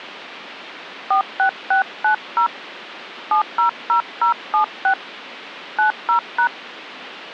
DTMF, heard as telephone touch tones, dialled by hand, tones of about 100 ms. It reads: 46690 700076 90#